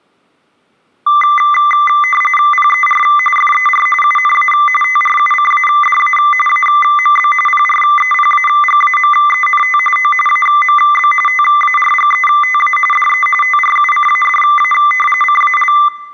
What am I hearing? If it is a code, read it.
RTTY (45.45 baud, 850 Hz shift), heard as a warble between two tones, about 1600 Hz centre. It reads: PER FER UNA TRUCADA AMB PREPAGAMENT O AMB TARGETA DE TRUCADA CAL